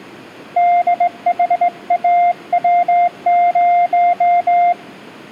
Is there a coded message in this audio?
Yes: Morse code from 0.5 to 4.8 s, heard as a keyed tone, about 19 wpm, 700 Hz. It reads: DHAW0